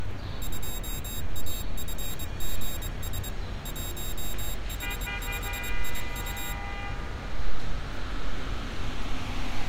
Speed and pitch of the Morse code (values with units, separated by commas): 23 wpm, 3750 Hz